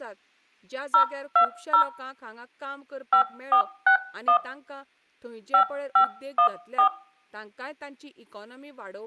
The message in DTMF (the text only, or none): 020 5461 5514